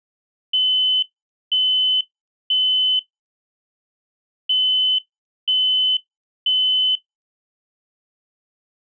Alarm pattern, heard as an alarm's beeps, played twice, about 3050 Hz. Temporal three. Smoke or fire, evacuate.